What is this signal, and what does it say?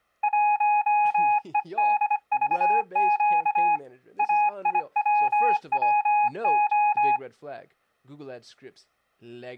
Morse code, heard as a keyed tone, hand-sent with a bug key, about 25 wpm, 830 Hz, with speech in English. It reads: 1EDVQ AIWWO